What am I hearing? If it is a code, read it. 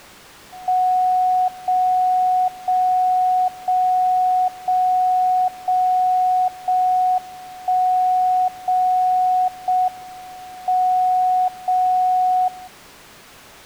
Radio time signal (JJY), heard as a tone whose level steps once a second, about 740 Hz. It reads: 0 0 0 0 0 0 1 0 0 M 0 0